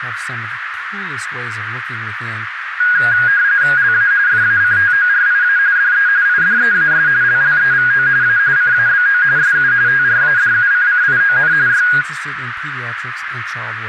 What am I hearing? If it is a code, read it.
RTTY (45.45 baud, 170 Hz shift), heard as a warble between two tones, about 1550 Hz centre, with radio static, a narrow filter and speech in English. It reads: LA FACTORIA DE IDEAS LLEVO A CABO SU TRADUCCION Y